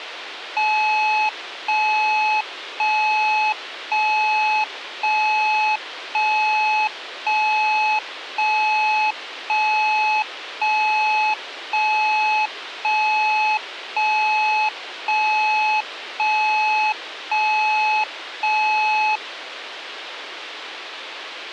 Evenly repeated beeps, with radio hiss. There is no code.